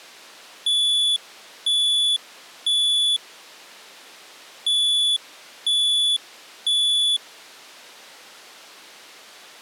Alarm pattern, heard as an alarm's beeps, played twice, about 3450 Hz. Temporal three. Smoke or fire, evacuate.